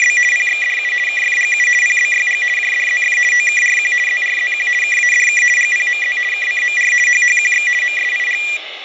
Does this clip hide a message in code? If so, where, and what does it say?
Yes: RTTY (50 baud, 450 Hz shift) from 0.0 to 8.6 s, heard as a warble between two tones, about 2200 Hz centre, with radio static and fading. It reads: … PXDU KFGU PBYG JDZF OKRQ ZRZQ KADK GPMZ KCMR HHQX MSIG